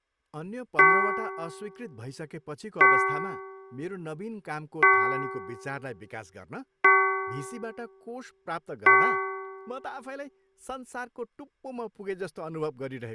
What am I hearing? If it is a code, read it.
Clock strike, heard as a bell, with speech in Nepali. 5. Five o'clock.